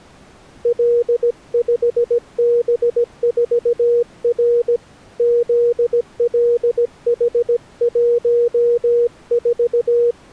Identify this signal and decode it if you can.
Morse code, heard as a keyed tone, hand-sent with a paddle, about 17 wpm, 480 Hz. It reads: L5B4R ZLH14